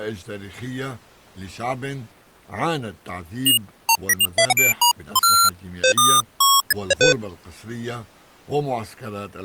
Electronic bleeps of random pitch and length, with speech in Arabic. There is no code.